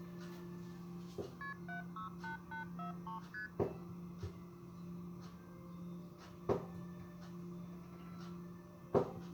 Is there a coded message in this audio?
Yes: multi-frequency trunk signalling (R1, as on North American trunks) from 1.4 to 3.5 s, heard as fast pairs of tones, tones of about 120 ms, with kitchen noise. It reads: KP 768843 ST